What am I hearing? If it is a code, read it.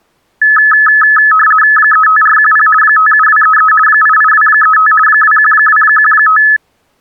RTTY (50 baud, 450 Hz shift), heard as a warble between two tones, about 1500 Hz centre. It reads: 35410 57233 88235 21215